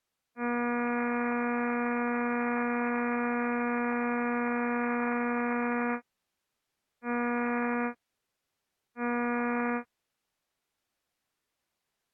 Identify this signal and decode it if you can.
Ship horn signal, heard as a ship's horn, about 240 Hz. 1 long, 2 short. At sea: a vessel in fog that is sailing, fishing, towing or hampered.